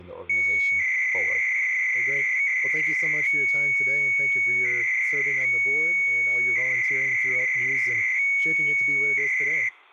300-baud modem data (Bell 103 tones), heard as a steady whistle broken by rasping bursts, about 300 baud, 200 Hz shift, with speech in English.